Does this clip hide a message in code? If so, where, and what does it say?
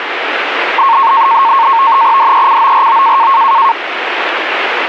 Yes: NAVTEX (SITOR-B), 100 baud, 170 Hz shift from 0.8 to 3.7 s, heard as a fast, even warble, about 1000 Hz centre, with radio static. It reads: DECORO